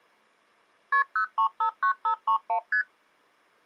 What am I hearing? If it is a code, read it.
Multi-frequency trunk signalling (R1, as on North American trunks), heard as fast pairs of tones, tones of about 90 ms. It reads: KP 0359531 ST